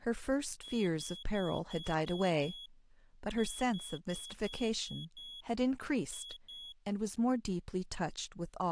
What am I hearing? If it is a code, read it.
Beep code, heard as a piezo beeper, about 3350 Hz, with speech in English. 6-6-2.